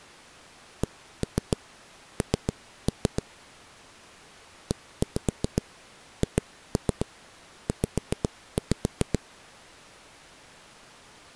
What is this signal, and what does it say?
Tap code, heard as knocks on a wall, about 7 knocks a second. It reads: CN EHZ